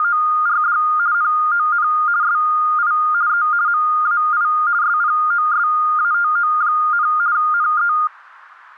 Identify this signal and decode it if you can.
RTTY (50 baud, 170 Hz shift), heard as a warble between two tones, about 1320 Hz centre. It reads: … NON SI E MAI SPOSATO, NE